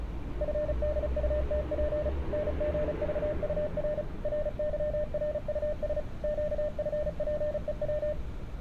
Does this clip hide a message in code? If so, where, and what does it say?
Yes: Morse code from 0.4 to 8.2 s, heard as a keyed tone, machine-sent, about 35 wpm, 600 Hz, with street noise. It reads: FDUTP NGVUR RYRUS QFPEW